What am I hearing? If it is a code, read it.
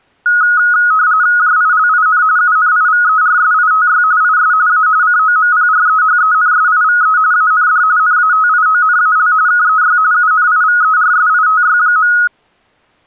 RTTY (45.45 baud, 170 Hz shift), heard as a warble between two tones, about 1360 Hz centre. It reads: JILIN UNIVERSITY IS A COMPREHENSIVE AND NATIONAL KEY UNIVERSITY.